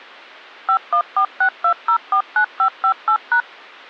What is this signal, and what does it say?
DTMF, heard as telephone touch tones, dialled by machine, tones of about 80 ms. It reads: 51462049558#